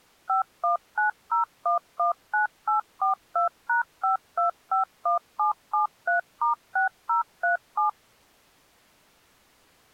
DTMF, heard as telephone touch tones, dialled by machine, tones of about 120 ms. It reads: 5190119842#5251773*6037